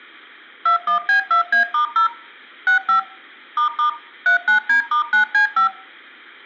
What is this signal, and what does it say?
DTMF, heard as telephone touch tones, dialled by machine, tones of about 110 ms. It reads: 21B2A*0 65 ** 39D*9C5